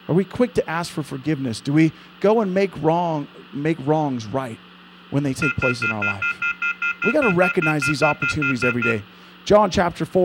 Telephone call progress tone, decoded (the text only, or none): off-hook warning tone